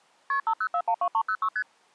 Multi-frequency trunk signalling (R1, as on North American trunks), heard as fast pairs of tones, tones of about 70 ms. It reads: KP 50412306 ST